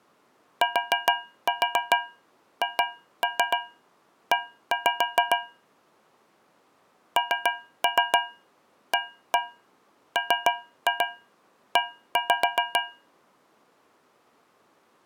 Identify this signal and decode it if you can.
Tap code, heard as taps on a metal pipe, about 7 knocks a second. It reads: THE NAME